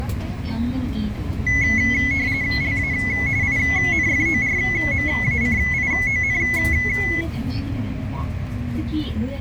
RTTY (45.45 baud, 170 Hz shift), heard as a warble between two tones, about 2100 Hz centre, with the noise inside a bus. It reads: LA INFORMACION